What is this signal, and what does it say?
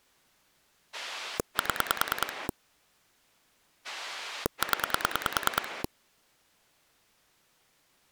Pulse dialling, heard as a rotary dial, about 9 pulses a second. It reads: 7 0